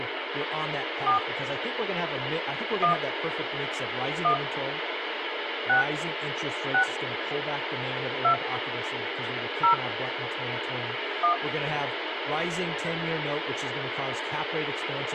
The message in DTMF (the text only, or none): 4 1 1 6 6 2 0 1